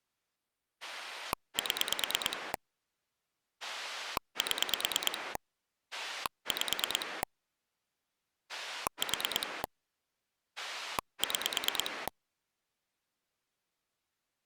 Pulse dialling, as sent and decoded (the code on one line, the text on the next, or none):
7 / 7 / 5 / 4 / 6
7 7 5 4 6